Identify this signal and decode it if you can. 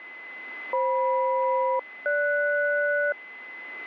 Aircraft SELCAL, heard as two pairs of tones, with a steady whistle near 2030 Hz. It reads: FM-GS